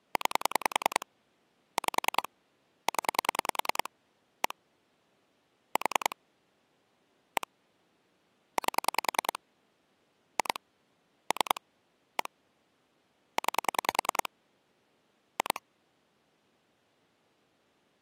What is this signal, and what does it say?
Pulse dialling, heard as clicks on a phone line, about 10 pulses a second. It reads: 9 5 0 1 4 1 8 2 3 1 9 2